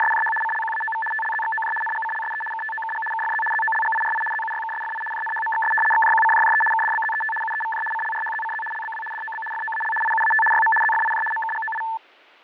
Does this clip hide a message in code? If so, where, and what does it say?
Yes: RTTY (75 baud, 850 Hz shift) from 0.0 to 12.0 s, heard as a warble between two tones, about 1320 Hz centre, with fading. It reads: … CLQAOV TLZXOJ NGCLSE KTOKG KFZ ZOLGIRI ZUYKSFI JNHMXS XJQCJJE KDBZET UEVJ CLRHZCZ LBW DOB FOAL IUAT YM ZFIJ MKGOI